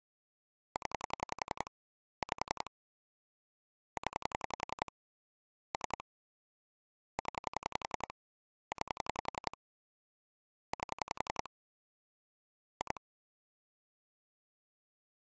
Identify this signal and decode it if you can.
Pulse dialling, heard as clicks on a phone line, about 11 pulses a second. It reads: 0 5 0 3 0 9 8 2